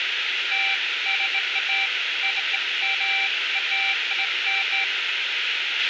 Beeps of irregular length, with radio hiss, a squelch burst at the end and room echo. There is no code.